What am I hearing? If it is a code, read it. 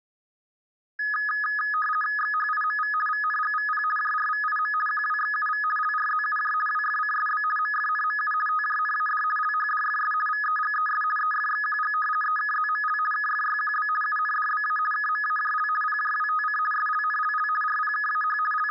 RTTY (50 baud, 450 Hz shift), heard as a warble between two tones, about 1480 Hz centre. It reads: XHIMV VNGVP JRVIM QWXUV LRZUJ WFCSB MFNMU TJNAD LHDFS VEGES EFXQG EKZML KFYQB UNDBA KMAJL PJWTC SLNLL RPKAH …